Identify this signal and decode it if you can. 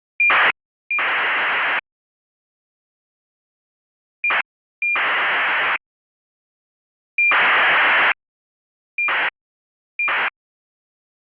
ACARS aircraft data, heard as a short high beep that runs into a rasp, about 2400 baud.